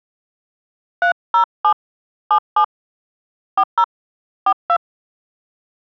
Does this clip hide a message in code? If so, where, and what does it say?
Yes: DTMF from 1.0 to 4.8 s, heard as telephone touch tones, dialled by hand, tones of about 80 ms. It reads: 307 77 40 42